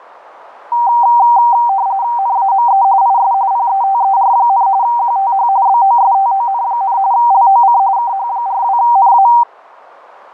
RTTY (45.45 baud, 170 Hz shift), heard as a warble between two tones, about 860 Hz centre, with radio static. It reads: NAME IS PETER, QTH BOSTON, LOC KH42NA